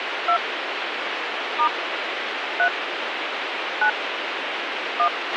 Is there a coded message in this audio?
Yes: DTMF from 0.3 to 5.1 s, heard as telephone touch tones, dialled by hand, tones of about 80 ms, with radio hiss and a squelch burst at the end. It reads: 2 * 3 9 1